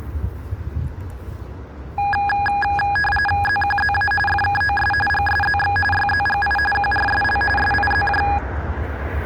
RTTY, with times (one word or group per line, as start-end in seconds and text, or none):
3.4-4.1 ZQZA
4.3-4.9 FKOS
5.1-5.8 GSZX
5.9-6.6 YZGI
6.7-7.4 QRSL
7.6-8.2 SIZJ